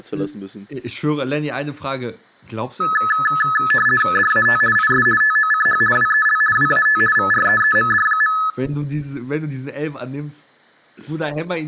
RTTY (50 baud, 450 Hz shift), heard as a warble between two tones, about 1500 Hz centre. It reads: DAT IS TOCH WEL WAT VREEMD.